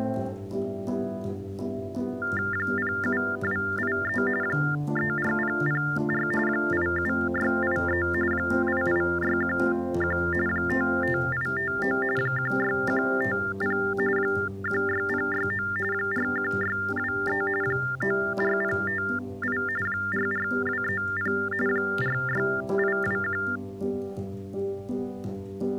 TTY/TDD text telephone tones (45.45 baud Baudot), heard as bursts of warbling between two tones, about 400 Hz shift, 1600 Hz centre. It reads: 07283 34004 87683 88611 55859 16150 16069 41623 94058 44230 46821